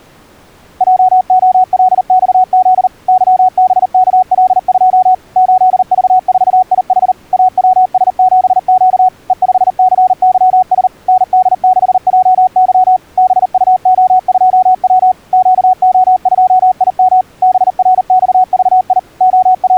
Morse code, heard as a keyed tone, machine-sent, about 39 wpm, 740 Hz. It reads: JOLXZ YBKL2 8V4IH AWS7Q E5CYS ND6JY BUO2W QO2IM BRXVI …